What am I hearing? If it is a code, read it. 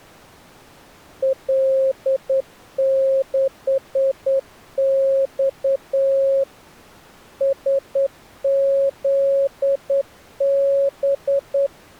Morse code, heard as a keyed tone, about 9 wpm, 540 Hz. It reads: L6X SZB